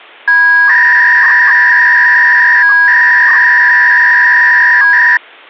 300-baud modem data (V.21 tones), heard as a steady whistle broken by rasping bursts, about 300 baud, 200 Hz shift.